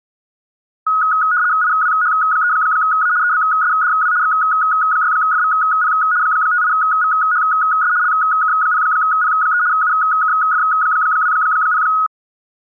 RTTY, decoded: IWH3A EBSDW X6FVP 58VHS LK0P3 UKF20

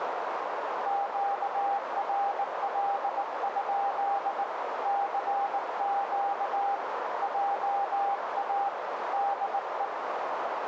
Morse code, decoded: QRL? CQ JA DE

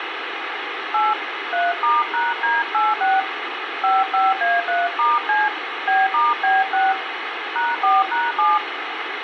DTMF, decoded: 8 3*#D86 55A3*C B*B6 #4#7

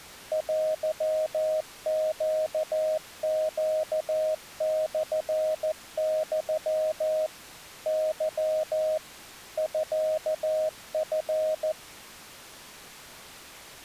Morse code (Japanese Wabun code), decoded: テネネモユ ケ ミチ

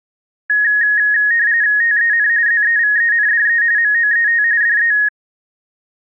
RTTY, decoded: TEN ZEVENDE MOET DE

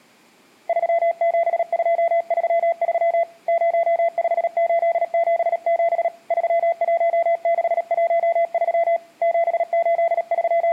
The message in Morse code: 37233 05877 31613 …

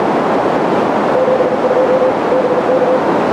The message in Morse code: 72 BK

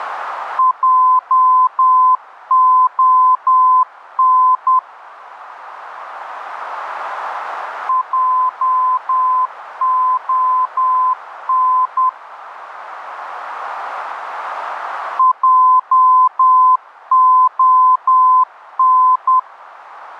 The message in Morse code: JON JON JON

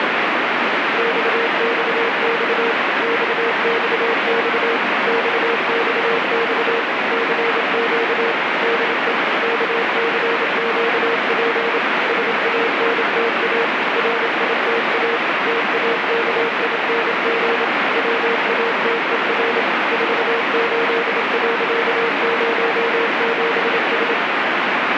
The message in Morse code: XXX XXX XXX CQ DE KCQP SANTA RITA TAKING WATER 48.07S

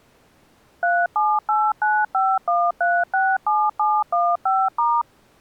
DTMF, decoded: 378951367715*

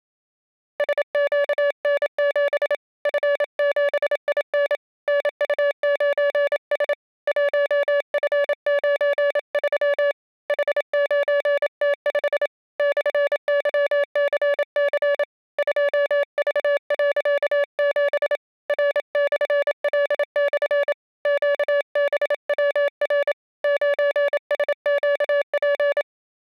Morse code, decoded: SQN7 F7IN NU9S 1F93 H9T5 /YCC 2V.7 R/L/ QBWR 9SQP

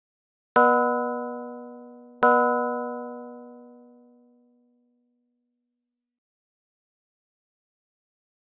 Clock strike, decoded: 2

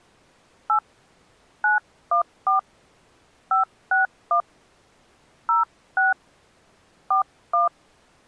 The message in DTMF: 8 914 561 06 41

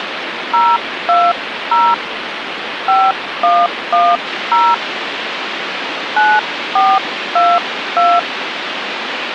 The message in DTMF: 020 5110 9422

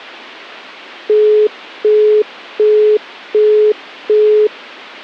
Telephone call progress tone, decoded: busy tone

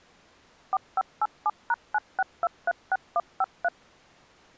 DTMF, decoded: 4587#96236153

